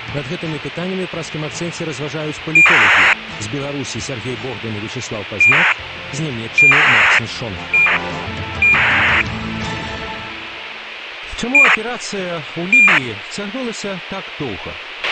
ACARS aircraft data, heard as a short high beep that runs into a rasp, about 2400 baud, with radio hiss and a squelch burst at the end.